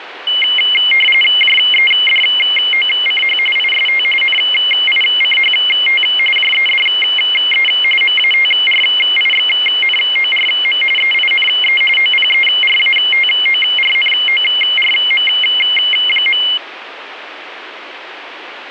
RTTY (45.45 baud, 850 Hz shift), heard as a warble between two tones, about 2550 Hz centre, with radio static. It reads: JEDOCH IST NICHT JEDE MATRIXNORM EINE OPERATORNORM.